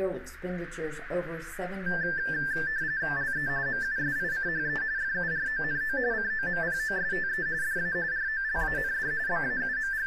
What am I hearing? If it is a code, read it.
RTTY (45.45 baud, 170 Hz shift), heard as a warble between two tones, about 1650 Hz centre, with radio static. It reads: LE MUSICHE FURONO COMPOSTE DA ROLAND …